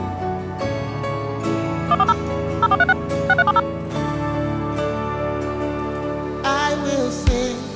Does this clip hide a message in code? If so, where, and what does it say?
Yes: DTMF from 1.9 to 3.6 s, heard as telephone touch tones, dialled by machine, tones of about 40 ms. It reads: 140 0436 6370